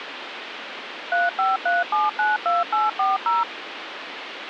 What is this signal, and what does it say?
DTMF, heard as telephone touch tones, dialled by machine, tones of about 180 ms, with phone line noise. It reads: 353792840